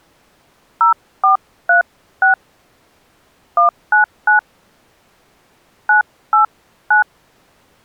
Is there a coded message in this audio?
Yes: DTMF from 0.8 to 7.0 s, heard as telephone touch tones, dialled by hand, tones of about 120 ms. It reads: 0436 199 989